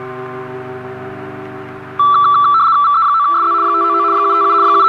RTTY (75 baud, 170 Hz shift), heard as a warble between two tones, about 1240 Hz centre, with radio static. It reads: VE9SZ 599 757 …